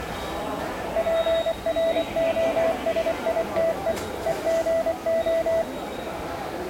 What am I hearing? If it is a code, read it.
Morse code (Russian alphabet), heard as a keyed tone, machine-sent, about 24 wpm, 660 Hz, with the noise of a subway station. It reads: ПРОСИТЕ ЕГО